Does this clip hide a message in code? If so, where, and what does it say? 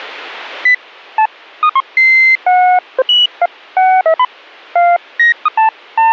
No, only electronic bleeps of random pitch and length.